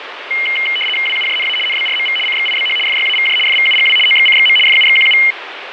RTTY (75 baud, 850 Hz shift), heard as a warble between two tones, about 2550 Hz centre, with radio static. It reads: WUJNA NBRMV CXIBH FYAVJ FVUGW OXCXM FUXQU